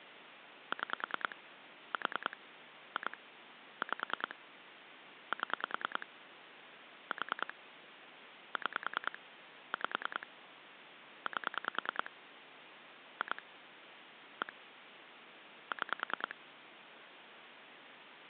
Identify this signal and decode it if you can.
Pulse dialling, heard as clicks on a phone line, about 10 pulses a second, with phone line noise. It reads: 6 4 2 5 7 4 6 5 8 2 1 6